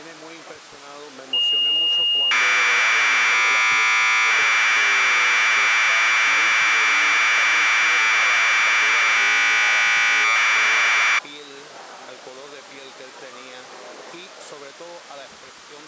Commodore tape loading (standard loader), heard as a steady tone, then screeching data.